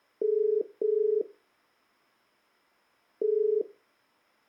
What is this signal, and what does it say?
Telephone call progress tone (as in the UK, Ireland, Australia and similar networks), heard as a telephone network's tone, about 430 Hz. Ringback tone.